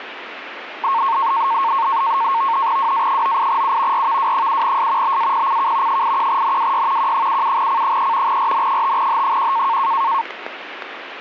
NAVTEX (SITOR-B), 100 baud, 170 Hz shift, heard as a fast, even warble, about 1000 Hz centre, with radio static. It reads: WA98U RVW7S BAPCK 81NWY Q77C3 RN5H1